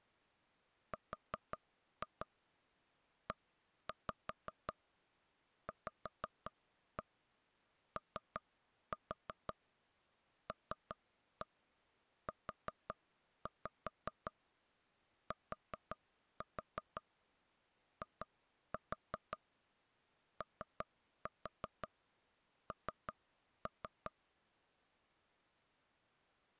Tap code, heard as taps on a table, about 5 knocks a second. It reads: REVOLUTION